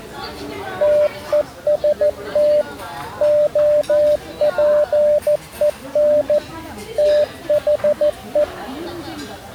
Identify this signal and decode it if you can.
Morse code, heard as a keyed tone, machine-sent, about 14 wpm, 600 Hz, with the noise of a restaurant. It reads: TEST OPEN THE